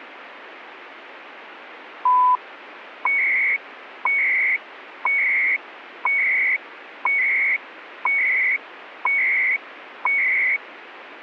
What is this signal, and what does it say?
Radio time signal (CHU, Canada), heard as beeps and data bursts, one a second, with radio static.